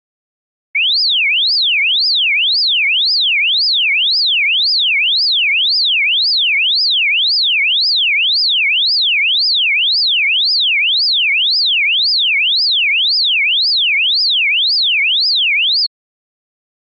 A tone that sweeps in pitch again and again. There is no code.